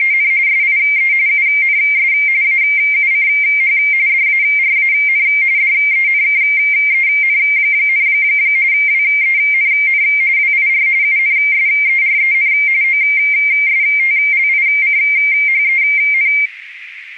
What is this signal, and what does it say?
RTTY (45.45 baud, 170 Hz shift), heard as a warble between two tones, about 2200 Hz centre, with radio static. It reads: … SIE UNS AUCH DARAN DENKEN, WENN WIR UNSEREN OSTLICHEN